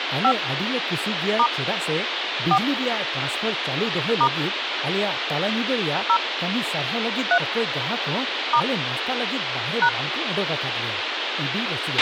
DTMF, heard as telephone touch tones, dialled by hand, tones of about 70 ms, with radio hiss, a squelch burst at the end and speech in Santali. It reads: 5 * 4 * 0 3 * #